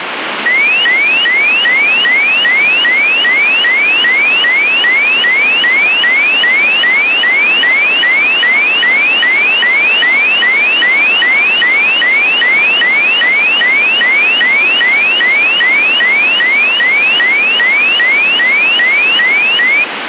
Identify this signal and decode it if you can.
A tone that sweeps in pitch again and again, with radio static. There is no code.